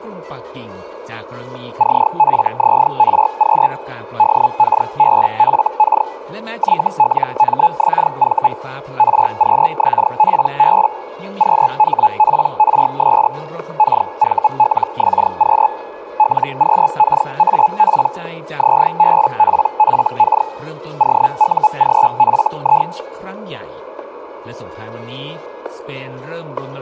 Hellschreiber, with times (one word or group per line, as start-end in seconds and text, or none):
1.8-3.7 CFZRQ
4.2-6.1 DKBFK
6.6-8.5 YLMXV
9.0-10.9 RQXPB
11.4-13.3 QHPRS
13.8-15.7 KVLXQ
16.2-18.1 LQKAP
18.6-20.5 ZBPFK
21.0-22.9 OUGFI